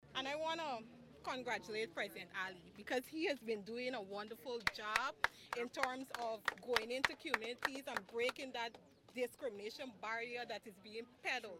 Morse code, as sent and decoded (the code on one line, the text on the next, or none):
none